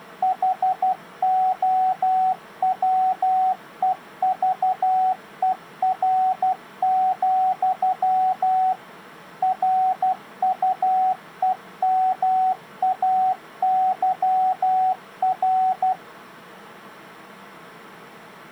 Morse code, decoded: HOWEVER, RUEMAYR

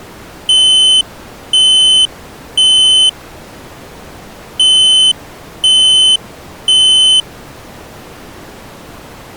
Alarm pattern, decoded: temporal three

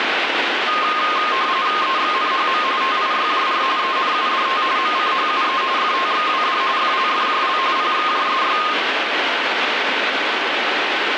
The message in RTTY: EXNHM TIYJR ENUDT MCHUE FTXWD FLFJL PXJSY

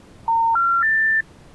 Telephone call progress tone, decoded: special information tone

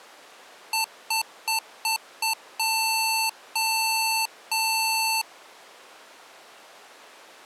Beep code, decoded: 5 short, 3 long

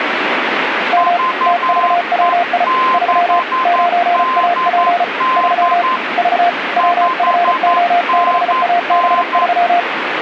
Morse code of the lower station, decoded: M TVWI 3 9AP 3 V WFO6AB3

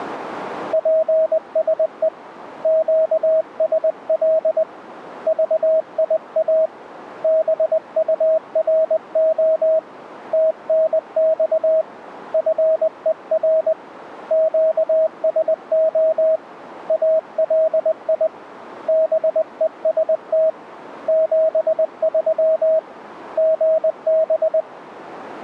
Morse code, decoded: PSE QSL VIA BURO TNX FER QSO ALI BEST 73 GB

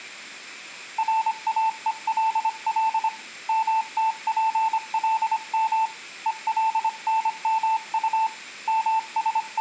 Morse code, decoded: RAELL MTPLM ELNMU …

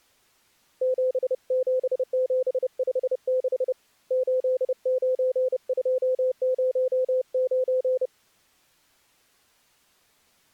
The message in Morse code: 77756 89209

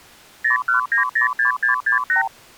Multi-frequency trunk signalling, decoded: 01906668

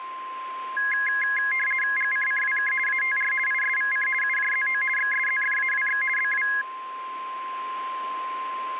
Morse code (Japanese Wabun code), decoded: none

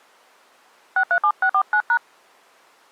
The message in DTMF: 637649#

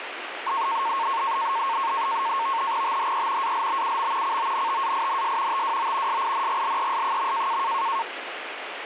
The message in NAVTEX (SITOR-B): THE ALBUM CONTAINS TWO SINGLES.

